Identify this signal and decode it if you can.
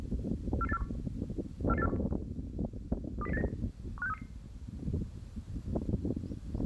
Five-tone selective call (EEA), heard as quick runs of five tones, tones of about 40 ms, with the noise of a park. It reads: 44841 44841 20089 15633